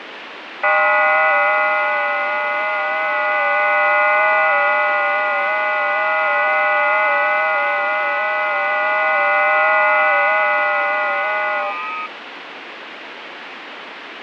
FT8 (several signals at once), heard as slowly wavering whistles, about 6.25 baud, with radio static.